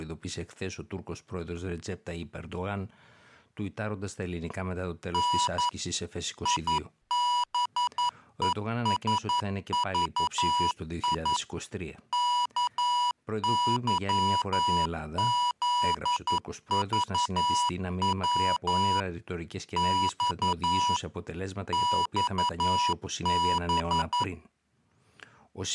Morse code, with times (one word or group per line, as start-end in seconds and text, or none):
5.1-5.7 N
6.5-11.4 IBESVI
12.1-19.0 KYZVW
19.8-21.0 X
21.7-24.2 XB